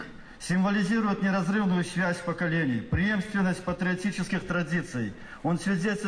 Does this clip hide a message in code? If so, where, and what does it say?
No.